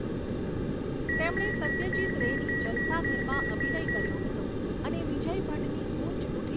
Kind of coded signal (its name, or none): beep code